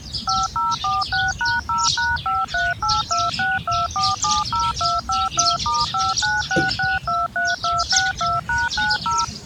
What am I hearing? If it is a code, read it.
DTMF, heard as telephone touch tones, dialled by machine, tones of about 190 ms, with the noise of a park. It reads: 5046#0#538262470252*596623262#90